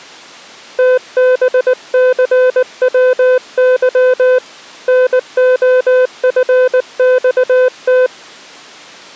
Morse code, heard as a keyed tone, hand-sent with a paddle, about 19 wpm, 510 Hz. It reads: TBCWY NOFXT